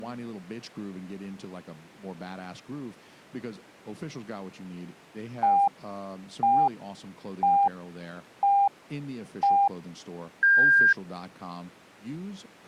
Radio time signal (five pips and a higher one, as on Chinese radio), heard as pips, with speech in English.